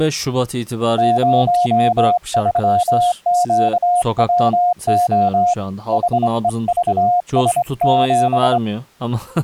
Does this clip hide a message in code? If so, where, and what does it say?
Yes: Morse code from 0.9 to 8.6 s, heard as a keyed tone, hand-sent with a straight key, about 24 wpm, 710 Hz, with speech in Turkish. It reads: 03QWO HEVS7